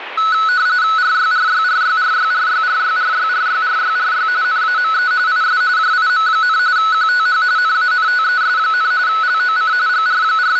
RTTY (45.45 baud, 170 Hz shift), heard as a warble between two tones, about 1390 Hz centre, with radio static. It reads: RYRYRYRYRYRYRYRYRYRY NAME IS JIM, QTH NANTES, LOC …